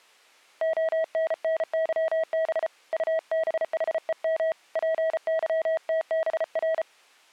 Morse code, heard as a keyed tone, hand-sent with a paddle, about 34 wpm, 640 Hz. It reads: ONNYB UBHEM PYTBR